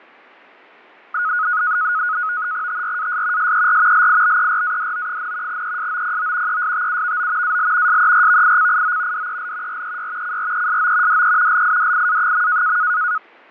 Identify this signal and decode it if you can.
NAVTEX (SITOR-B), 100 baud, 170 Hz shift, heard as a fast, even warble, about 1360 Hz centre, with fading. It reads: TRAS SER LIBERADO, ESOPO ESTUVO AL SERVICIO DEL REY CRESO DE LIDIA.